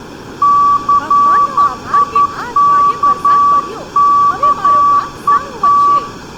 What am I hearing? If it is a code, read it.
Morse code, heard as a keyed tone, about 11 wpm, 1150 Hz, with room echo and speech in Gujarati. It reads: CIKKET